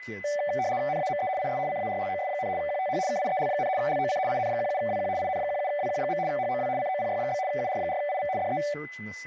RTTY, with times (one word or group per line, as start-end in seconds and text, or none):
0.9-1.3 NAME
1.4-1.6 IS
1.7-2.5 CARLOS,
2.6-3.0 QTH
3.1-3.7 KIEL,
3.8-4.2 LOC
4.3-5.1 IN17WQ
5.2-6.2 IN17WQ.
6.3-6.7 HOW
6.8-7.4 COPY?
7.5-8.3 UR4IV
8.4-8.6 DE